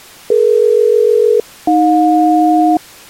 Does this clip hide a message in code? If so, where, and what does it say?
Yes: aircraft SELCAL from 0.3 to 2.8 s, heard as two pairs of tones. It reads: DE-AJ